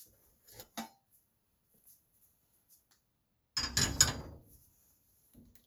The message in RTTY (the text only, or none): none